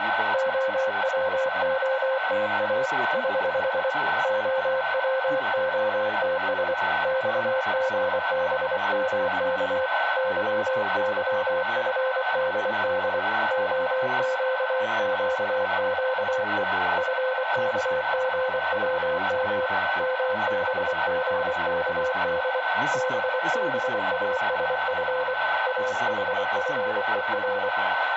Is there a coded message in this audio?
Yes: Morse code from 0.3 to 27.7 s, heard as a keyed tone, hand-sent with a paddle, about 24 wpm, 520 Hz, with radio static, a steady whistle near 1520 Hz, room echo and speech in English. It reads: OWOTA <HH> OWOTS XGBMK YYFDD OQQQE FKGWM MBGKD BBASF AHFER